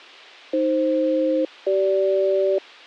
Aircraft SELCAL, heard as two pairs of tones. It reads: AF-CG